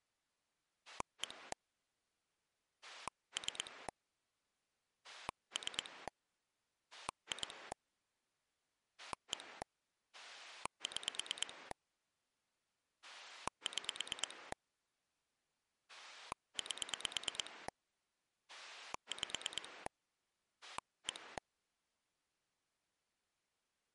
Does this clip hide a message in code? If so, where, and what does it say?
Yes: pulse dialling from 0.9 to 21.4 s, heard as a rotary dial, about 9 pulses a second. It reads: 1 3 3 2 1 6 6 8 5 1